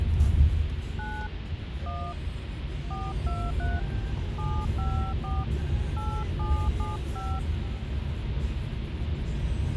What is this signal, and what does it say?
DTMF, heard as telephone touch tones, dialled by hand, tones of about 260 ms, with phone line noise and the noise inside a car. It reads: 9 1 423 754 8775